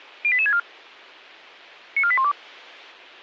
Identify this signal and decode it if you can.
Five-tone selective call (ZVEI), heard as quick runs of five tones, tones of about 70 ms. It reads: 08864 94812